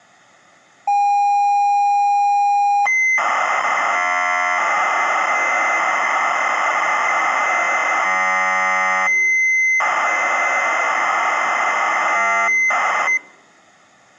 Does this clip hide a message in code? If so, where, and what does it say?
Yes: ZX Spectrum tape loading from 0.9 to 13.2 s, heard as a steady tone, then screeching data.